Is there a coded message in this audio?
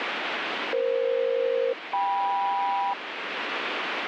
Yes: aircraft SELCAL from 0.7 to 2.9 s, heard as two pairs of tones, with heavy radio static. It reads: EF-KM